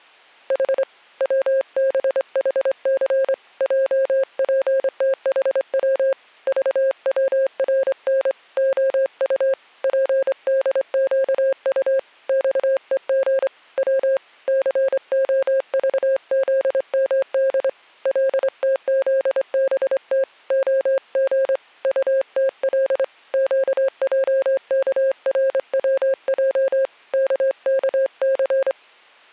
Morse code, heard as a keyed tone, hand-sent with a straight key, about 25 wpm, 540 Hz. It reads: H WBHC JPTHW VWRN OU PDQU XEG W COVZMD LTZBT OG UTL QJKRWJ KKC